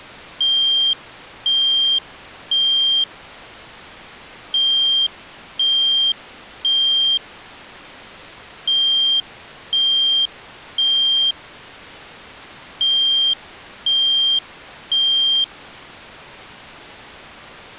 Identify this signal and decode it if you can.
Alarm pattern, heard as an alarm's beeps, played four times, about 3200 Hz. Temporal three. Smoke or fire, evacuate.